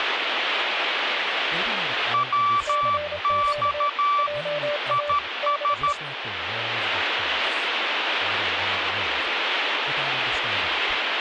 Morse code, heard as two keyed tones, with radio static and speech in English. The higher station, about 13 wpm, 1160 Hz: WX IS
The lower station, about 27 wpm, 590 Hz: CQ JA DE